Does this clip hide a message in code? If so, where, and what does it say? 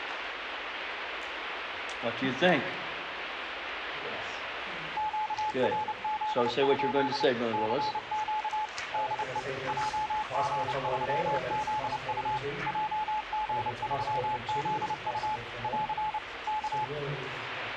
Yes: Morse code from 4.9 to 16.9 s, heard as a keyed tone, machine-sent, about 29 wpm, 860 Hz, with radio static. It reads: QRZ? CQ DE JG3ZU JG3ZU <AR> K